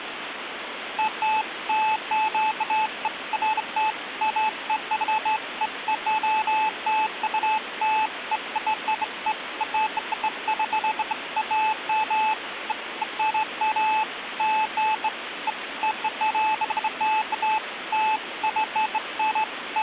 Beeps of irregular length, with phone line noise. There is no code.